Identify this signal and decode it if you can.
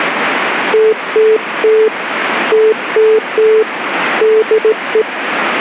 Morse code, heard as a keyed tone, hand-sent with a straight key, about 17 wpm, 440 Hz, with radio static. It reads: TTT TTT DE